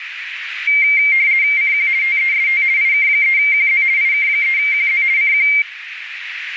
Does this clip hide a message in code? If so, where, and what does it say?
Yes: RTTY (50 baud, 170 Hz shift) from 0.7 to 5.6 s, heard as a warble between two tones, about 2200 Hz centre, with radio static and a narrow filter. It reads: CQ TEST IK3QZ IK3QZ CQ